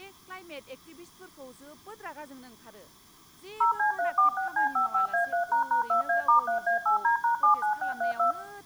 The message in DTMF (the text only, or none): 0C346C55A3##2A*3A8D#79632